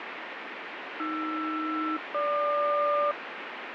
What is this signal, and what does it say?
Aircraft SELCAL, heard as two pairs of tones, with radio static. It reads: AR-GQ